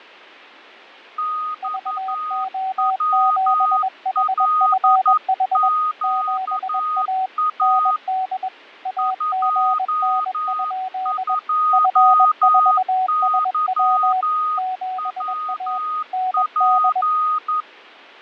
Morse code, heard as two keyed tones, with fading. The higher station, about 11 wpm, 1240 Hz: XWLQA 22YWP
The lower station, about 21 wpm, 750 Hz: VO7HFH 7A ND AGN? F4SW 7A ND